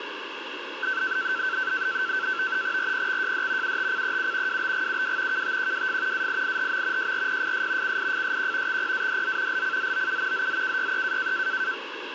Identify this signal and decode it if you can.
NAVTEX (SITOR-B), 100 baud, 170 Hz shift, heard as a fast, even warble, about 1450 Hz centre, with radio static. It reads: RPXJD UTCEU WBGUW KTQWF AIIHM JRPFS CIFSQ XPADZ LCZOU ZZKYE